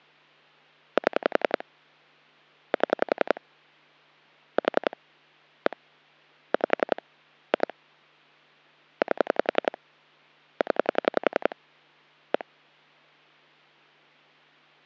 Pulse dialling, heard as clicks on a phone line, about 11 pulses a second. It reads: 7 7 4 1 5 2 8 0 1